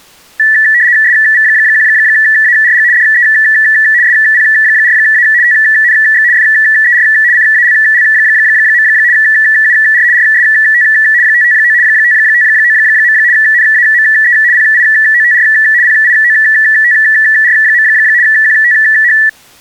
RTTY (75 baud, 170 Hz shift), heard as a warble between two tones, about 1850 Hz centre. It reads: SV1ARG DE SP4A TNX FER CALL. UR RST 559 559. NAME PIOTR PIOTR. QTH